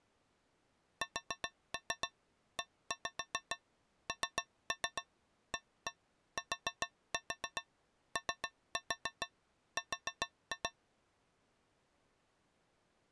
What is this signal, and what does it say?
Tap code, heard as taps on a metal pipe, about 7 knocks a second. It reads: SENATOR